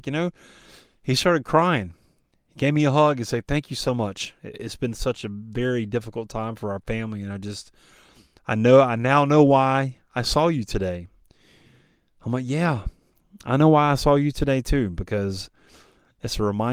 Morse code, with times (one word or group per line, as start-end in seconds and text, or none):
none